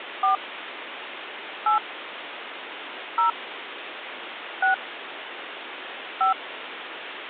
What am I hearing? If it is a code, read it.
DTMF, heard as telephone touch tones, dialled by hand, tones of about 120 ms, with phone line noise. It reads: 4 8 0 6 5